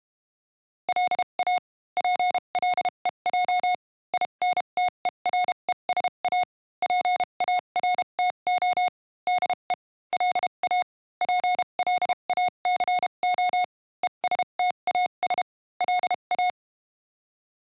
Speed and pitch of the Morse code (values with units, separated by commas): 32 wpm, spaced as for 27 wpm, 720 Hz